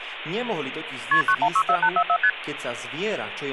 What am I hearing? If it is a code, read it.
Multi-frequency trunk signalling (R1, as on North American trunks), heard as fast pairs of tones, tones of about 70 ms, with phone line noise. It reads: KP 9164844 ST